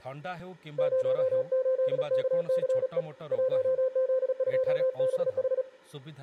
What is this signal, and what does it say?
Morse code, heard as a keyed tone, hand-sent with a paddle, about 36 wpm, 520 Hz, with room echo and speech in Odia. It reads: 08KCE 1Z2BH